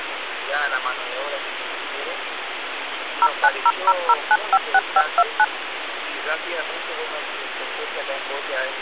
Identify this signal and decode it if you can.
DTMF, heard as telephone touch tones, dialled by machine, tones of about 50 ms, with phone line noise. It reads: 09000956529